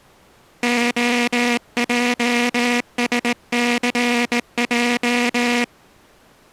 Morse code, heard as a buzzer, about 19 wpm. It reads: OJSCJ